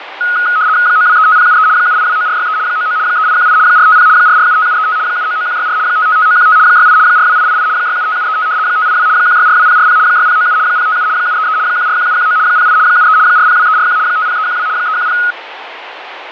RTTY (75 baud, 170 Hz shift), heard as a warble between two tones, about 1360 Hz centre, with radio static and fading. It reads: 9235073 7829463 99 3818 450 4475735 799164 555915 68 42888 675735 582 1642040 6097 057 733 141719 08 73 402341 50312 310